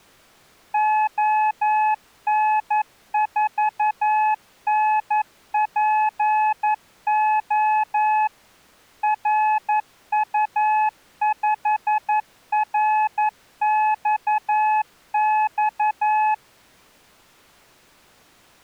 Morse code, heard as a keyed tone, machine-sent, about 11 wpm, 860 Hz. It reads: ON4NPO RU5RXX